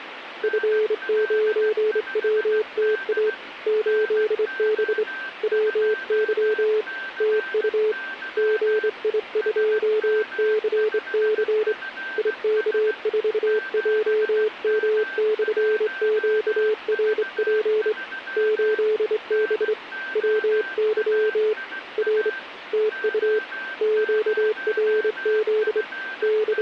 Morse code, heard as a keyed tone, hand-sent with a straight key, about 26 wpm, 430 Hz, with radio static and a weaker station near 1560 Hz. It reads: F9WTA 8B WY TU GI2CC IK4JM/QRP 8B WY R TU QRZ …